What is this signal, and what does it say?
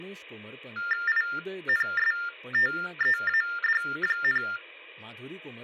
TTY/TDD text telephone tones (45.45 baud Baudot), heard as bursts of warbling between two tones, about 400 Hz shift, 1600 Hz centre, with speech in Goan Konkani. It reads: INSTEAD,